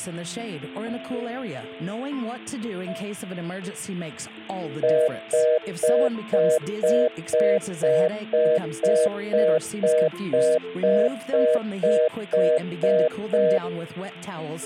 Telephone call progress tone (North American plan), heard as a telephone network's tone, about 480, 620 Hz, 0.25 s on and 0.25 s off. Congestion tone.